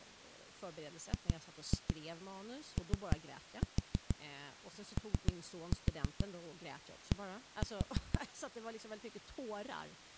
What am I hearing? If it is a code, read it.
Tap code, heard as knocks on a wall, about 6 knocks a second, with speech in Swedish. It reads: GOOD